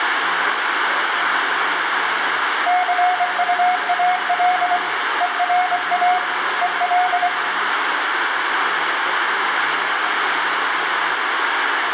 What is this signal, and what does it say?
Morse code, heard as a keyed tone, hand-sent with a paddle, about 24 wpm, 730 Hz, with radio static, room echo and speech in Maithili. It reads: CUAL ERA EL